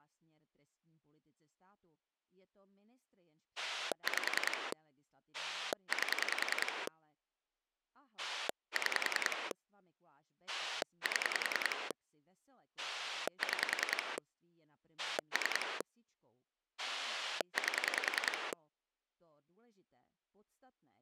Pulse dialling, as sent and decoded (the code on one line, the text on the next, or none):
5 / 8 / 6 / 7 / 6 / 3 / 8
5 8 6 7 6 3 8